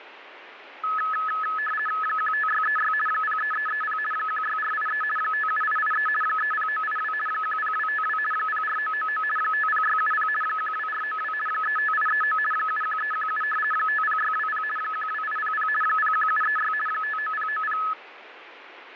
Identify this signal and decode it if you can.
RTTY (50 baud, 450 Hz shift), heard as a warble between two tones, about 1500 Hz centre, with radio static. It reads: 15636 03330 16483 57883 30982 10252 04999 50670 12492 35839 71317 50620 12800 01736 59090